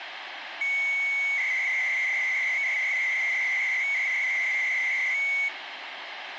300-baud modem data (Bell 103 tones), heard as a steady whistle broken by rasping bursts, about 300 baud, 200 Hz shift, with phone line noise.